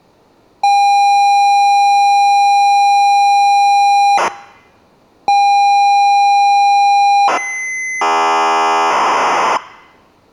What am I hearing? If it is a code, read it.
ZX Spectrum tape loading, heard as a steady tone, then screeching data.